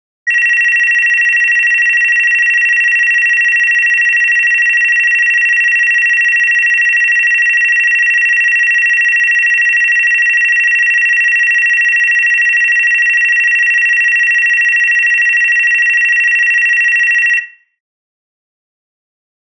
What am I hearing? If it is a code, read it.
A tone that alternates evenly between two pitches. There is no code.